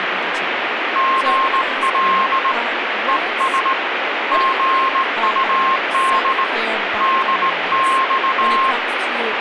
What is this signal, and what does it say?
Morse code, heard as a keyed tone, hand-sent with a straight key, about 18 wpm, 1060 Hz, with radio static and speech in English. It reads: GL ES GUD DX